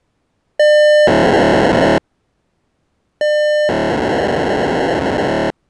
POCSAG pager data (1200 baud), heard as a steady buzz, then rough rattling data.